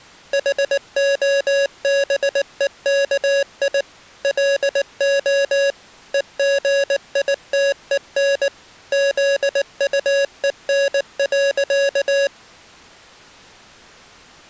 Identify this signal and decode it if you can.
Morse code, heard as electronic beeps, machine-sent, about 19 wpm, 560 Hz. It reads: HOBEKI LO EGITEN ZUEN.